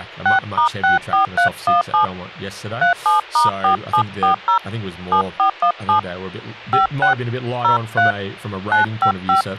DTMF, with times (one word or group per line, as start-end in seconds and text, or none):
0.3-2.0 6*64317
2.8-4.6 37*4740
5.1-6.0 7417
6.7-7.1 56
7.6-8.1 03
8.7-9.4 955